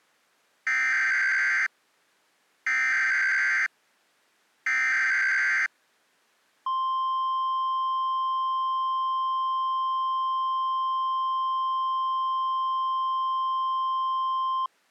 Emergency Alert System (SAME) tones (header bursts, then the 1050 Hz attention tone), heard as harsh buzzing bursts, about 520.83 baud.